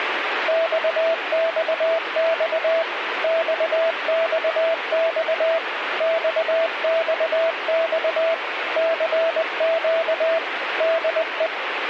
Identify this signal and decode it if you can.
Morse code, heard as a keyed tone, machine-sent, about 20 wpm, 660 Hz, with radio static. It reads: XXX XXX XXX CQ DE